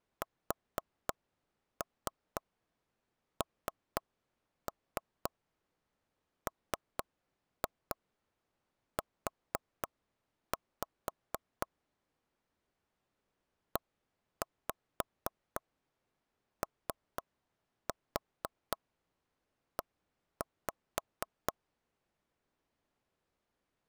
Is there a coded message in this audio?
Yes: tap code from 0.2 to 21.5 s, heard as taps on a table, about 4 knocks a second. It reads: SNMU EOE